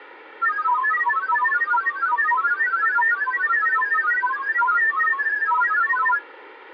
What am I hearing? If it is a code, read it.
Multi-tone FSK (Olivia or MFSK type), about 1000 Hz wide, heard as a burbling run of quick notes, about 31.25 baud.